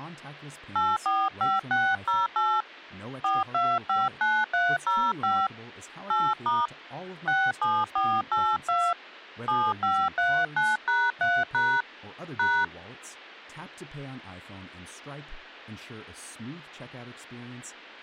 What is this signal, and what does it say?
DTMF, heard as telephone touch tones, dialled by hand, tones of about 230 ms, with speech in English. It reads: 845608 4259305 8* 67482 7539#3# #